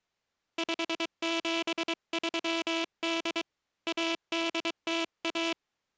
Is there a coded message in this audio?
Yes: Morse code (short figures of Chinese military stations) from 0.5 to 5.6 s, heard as a buzzer, hand-sent with a paddle, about 23 wpm. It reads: 5738 1801